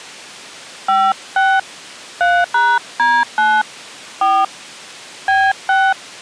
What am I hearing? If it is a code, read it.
DTMF, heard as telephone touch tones, dialled by hand, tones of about 240 ms. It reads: 56 3#D9 4 B6